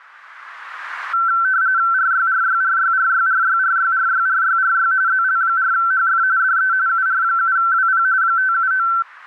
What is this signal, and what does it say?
RTTY (45.45 baud, 170 Hz shift), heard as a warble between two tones, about 1440 Hz centre. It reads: RYRYRYRYRYRYRYRYRY ZL4HF DE UR7WP 579